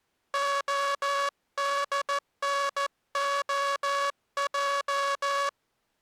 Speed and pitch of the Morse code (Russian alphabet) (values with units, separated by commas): 14 wpm